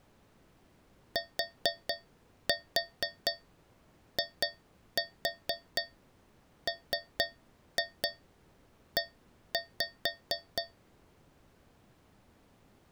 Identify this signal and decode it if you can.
Tap code, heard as taps on a metal pipe, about 4 knocks a second. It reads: TIME